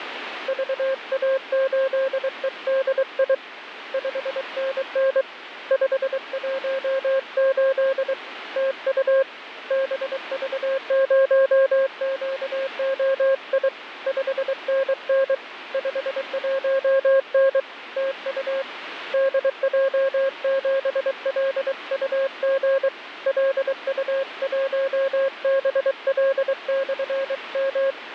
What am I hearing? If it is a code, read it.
Morse code, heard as a keyed tone, hand-sent with a paddle, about 23 wpm, 540 Hz, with radio static. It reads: VA8EDI 5NN 518 TU BV0QOI 5NN 51N TU DJ7LUG LU1BL/M